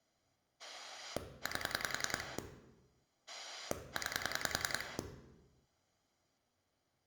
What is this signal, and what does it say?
Pulse dialling, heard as a rotary dial, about 10 pulses a second, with room echo. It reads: 8 9